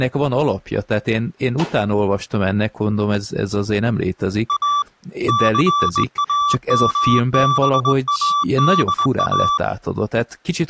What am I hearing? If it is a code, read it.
Morse code, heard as a keyed tone, hand-sent with a straight key, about 21 wpm, 1160 Hz, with speech in Hungarian. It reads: A CAMBADA